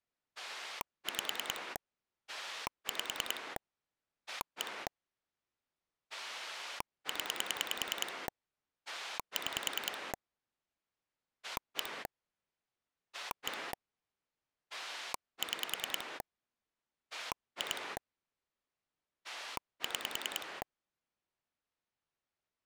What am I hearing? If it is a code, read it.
Pulse dialling, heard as a rotary dial, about 10 pulses a second. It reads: 5 5 1 0 6 1 1 6 2 6